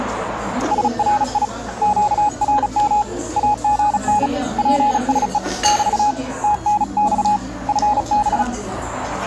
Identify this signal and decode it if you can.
Morse code, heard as a keyed tone, hand-sent with a paddle, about 36 wpm, 840 Hz, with radio static and the noise of a restaurant. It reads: SRI QRM AGN PSE <BT> TNX FB